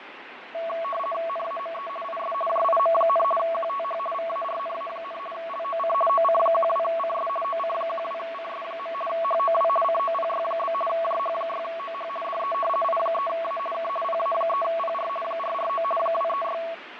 RTTY (50 baud, 450 Hz shift), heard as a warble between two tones, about 890 Hz centre, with radio static and fading. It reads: NAME IS JIM, QTH VARNA, LOC OC12CS OC12CS. HOW COPY? JH6OH DE I3A K PA3PR 449 236